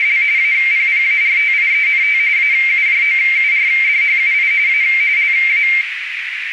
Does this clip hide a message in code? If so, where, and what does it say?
Yes: RTTY (45.45 baud, 170 Hz shift) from 0.0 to 5.8 s, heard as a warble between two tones, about 2200 Hz centre, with radio static and a narrow filter. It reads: … APPARTIENT AUJOURDHUI A LA